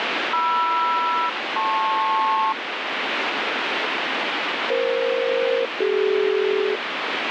Aircraft SELCAL, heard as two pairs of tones, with heavy radio static. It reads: MR-LP EF-CD